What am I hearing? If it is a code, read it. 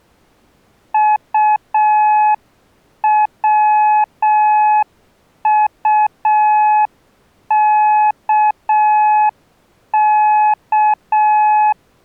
Morse code, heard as a keyed tone, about 6 wpm, 850 Hz. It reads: UWUKK